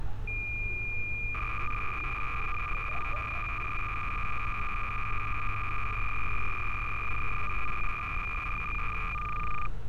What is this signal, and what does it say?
Cassette data (Kansas City type), 300 baud, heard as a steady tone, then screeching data, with street noise.